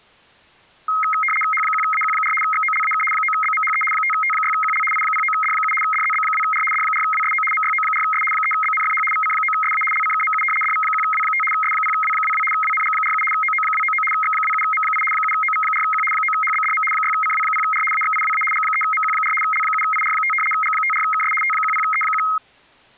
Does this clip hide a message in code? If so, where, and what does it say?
Yes: RTTY (75 baud, 850 Hz shift) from 0.9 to 22.4 s, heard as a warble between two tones, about 1700 Hz centre. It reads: H1AQ4 XOLAK 9BMHE 5T6QL I09D7 DZB2R D4WSO MYO4S 3BNFH VC9SA LCKMU DV1W5 S0W22 WNG47 OO299 X27M8 7OV4Q 9HBDM 6CW0R AXIWA G3MQ4 L7IR5 G54KS T10E1